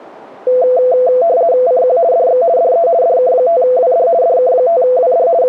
RTTY (50 baud, 170 Hz shift), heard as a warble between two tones, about 590 Hz centre. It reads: CQ DX DE DK5WD DK5WD …